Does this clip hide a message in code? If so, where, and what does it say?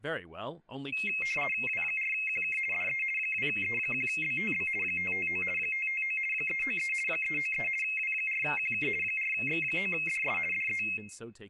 Yes: RTTY (50 baud, 450 Hz shift) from 0.9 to 11.0 s, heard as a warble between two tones, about 2350 Hz centre, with room echo and speech in English. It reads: W4QK DE 2E1BTB 559 559 393 393 W4QK 4X9DS DE